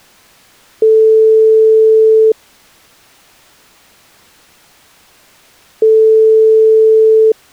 Telephone call progress tone (single-tone plan, as in most of Europe), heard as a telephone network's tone, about 440 Hz, 1.5 s on and 3.5 s off. Ringback tone.